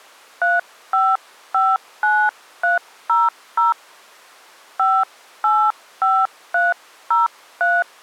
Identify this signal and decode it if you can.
DTMF, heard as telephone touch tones, dialled by hand, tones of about 200 ms. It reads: 3559300 585303